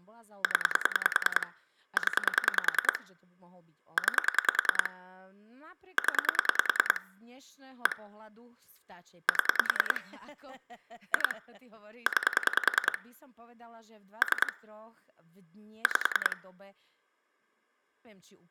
Pulse dialling, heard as clicks on a phone line, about 10 pulses a second, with speech in Slovak. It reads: 0 0 9 0 1 7 2 9 3 5